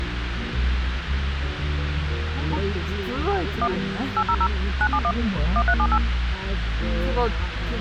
DTMF, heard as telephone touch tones, dialled by machine, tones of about 60 ms, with radio hiss and the noise inside a car. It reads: 1 800 971 1378